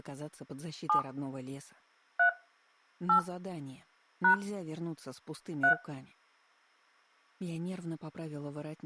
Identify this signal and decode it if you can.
DTMF, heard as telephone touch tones, dialled by hand, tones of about 100 ms. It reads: 7 3 8 # 3